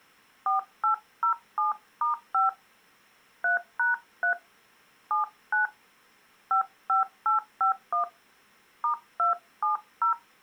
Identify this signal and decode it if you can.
DTMF, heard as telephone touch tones, dialled by hand, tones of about 120 ms. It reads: 4807*5 3#3 79 55851 *270